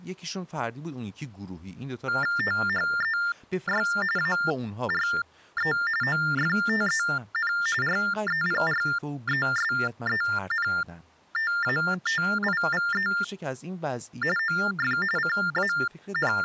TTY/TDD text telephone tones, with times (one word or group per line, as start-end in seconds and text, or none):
2.4-3.9 THEY
4.2-5.7 ARE
6.0-7.5 OFTEN
7.8-13.1 REPRESENTATIVE
14.4-15.0 OF
15.2-16.4 …